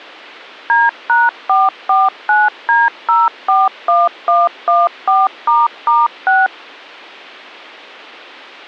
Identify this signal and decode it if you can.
DTMF, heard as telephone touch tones, dialled by machine, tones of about 190 ms. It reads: D#449D041114**6